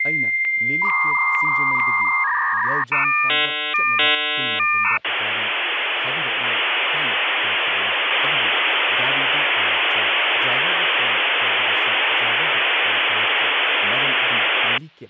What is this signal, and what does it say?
Dial-up modem handshake (V.34 or later), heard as a whistle, warbles, then hiss, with hum and speech in Manipuri.